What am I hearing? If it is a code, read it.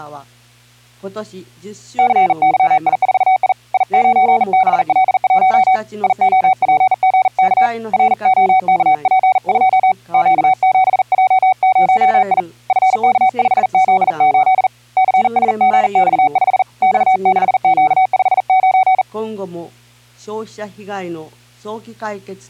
Morse code, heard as a keyed tone, hand-sent with a bug key, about 40 wpm, 750 Hz. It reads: CYI4I I9BL1 IOPGK ROKP2 Q7J0I FK5Z8 CSGX5 X6Q59